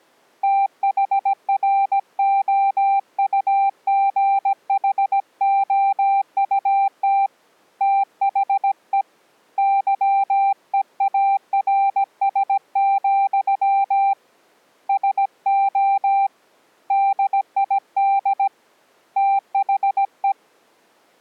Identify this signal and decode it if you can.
Morse code, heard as a keyed tone, hand-sent with a paddle, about 17 wpm, 790 Hz. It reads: THROUGHOUT THE YEARS, SO DID THE